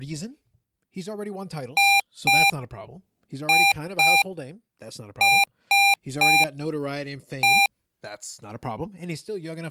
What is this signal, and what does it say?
Beep code, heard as beeps from a small speaker, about 800 Hz, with speech in English. 2-2-3-1. In Phoenix BIOS tables: unexpected interrupt.